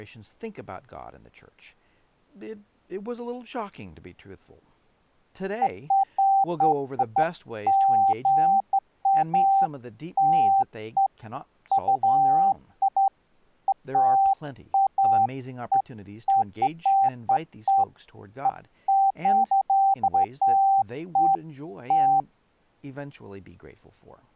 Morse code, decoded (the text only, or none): none